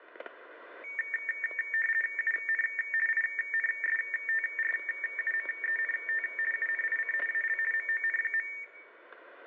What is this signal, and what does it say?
RTTY (50 baud, 450 Hz shift), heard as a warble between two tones, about 2000 Hz centre, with static crashes and room echo. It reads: UN INSTRUMENT UNIC AL MON.